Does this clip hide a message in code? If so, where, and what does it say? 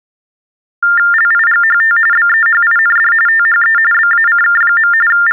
Yes: TTY/TDD text telephone tones (45.45 baud Baudot) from 0.8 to 5.3 s, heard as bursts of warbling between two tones, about 400 Hz shift, 1600 Hz centre. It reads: LIGHT BEHIND THE BACK. …